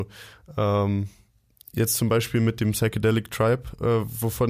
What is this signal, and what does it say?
Speech in German. There is no code.